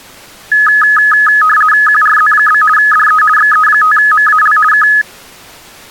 RTTY (50 baud, 450 Hz shift), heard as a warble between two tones, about 1480 Hz centre. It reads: QRZ? DE XE5MAL K